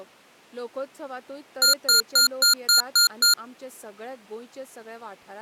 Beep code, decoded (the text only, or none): 7 short